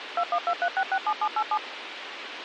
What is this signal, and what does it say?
DTMF, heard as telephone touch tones, dialled by machine, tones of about 60 ms, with radio hiss and a squelch burst at the end. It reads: 2123667787